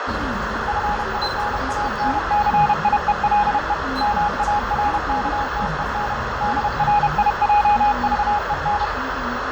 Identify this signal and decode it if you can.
Morse code, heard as a keyed tone, machine-sent, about 31 wpm, 830 Hz, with heavy radio static, fading, a narrow filter and the noise inside a bus. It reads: FINANCIELE MARKTEN DRIJVEN